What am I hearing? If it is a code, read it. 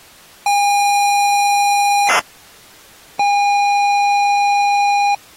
ZX Spectrum tape loading, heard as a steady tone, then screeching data.